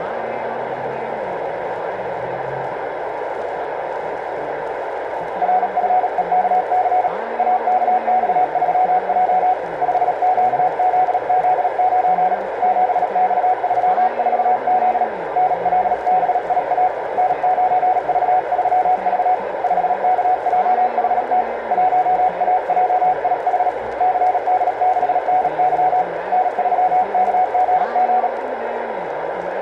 Morse code, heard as a keyed tone, hand-sent with a bug key, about 37 wpm, 740 Hz, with radio static and a narrow filter. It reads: RFEKC AKX3J 5QZZ9 7X34Z NLBIA N9V3V 5KJHT 1AJIH CD6NY N3KGG